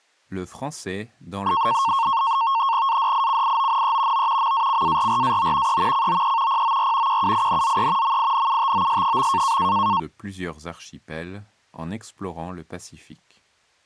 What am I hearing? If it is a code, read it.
NAVTEX (SITOR-B), 100 baud, 170 Hz shift, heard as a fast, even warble, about 1000 Hz centre, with speech in French. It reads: ADICIONE O MACARRAO E COE POR QUINZE MINUTOS.